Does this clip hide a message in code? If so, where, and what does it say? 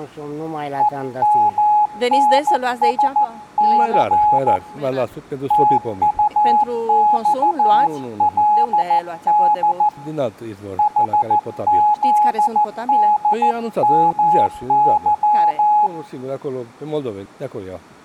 Yes: Morse code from 0.7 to 15.9 s, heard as a keyed tone, hand-sent with a paddle, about 14 wpm, 840 Hz, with room echo. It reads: EMNSC TUXLD HZDMY